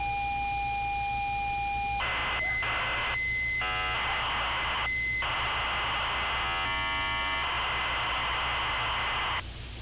ZX Spectrum tape loading, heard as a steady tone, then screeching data, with street noise.